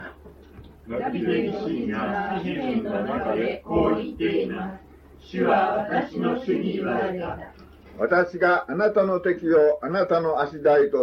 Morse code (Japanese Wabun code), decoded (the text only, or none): none